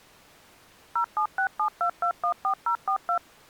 DTMF, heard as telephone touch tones, dialled by machine, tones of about 90 ms. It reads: 07672214042